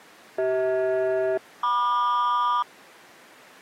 Aircraft SELCAL, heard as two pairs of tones. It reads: CH-MQ